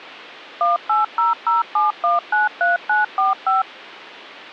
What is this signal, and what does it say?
DTMF, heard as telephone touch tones, dialled by machine, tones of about 150 ms. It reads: 18007193945